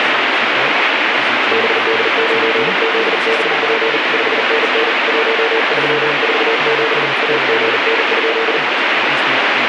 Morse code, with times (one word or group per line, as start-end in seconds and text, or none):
1.5-4.0 BD9ZBP
4.1-4.9 5NN
5.1-7.1 1347
7.2-8.6 AGN?